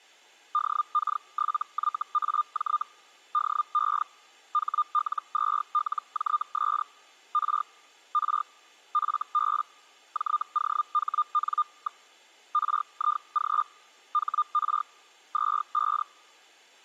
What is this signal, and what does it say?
Hellschreiber (Feld-Hell, 122.5 baud), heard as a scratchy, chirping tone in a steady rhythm, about 1210 Hz. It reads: DK7YAJ DE HL2LJS R R FB JOHN. RIG HR 25